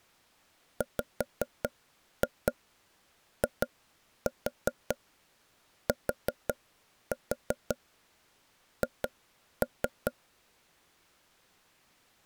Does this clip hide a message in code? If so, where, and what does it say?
Yes: tap code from 0.8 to 10.1 s, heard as taps on a table, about 5 knocks a second. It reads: WITH